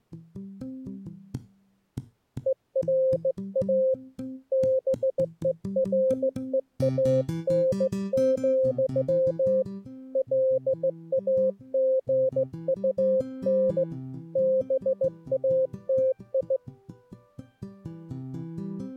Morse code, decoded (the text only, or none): ERA BEREAN, LAGUN BATI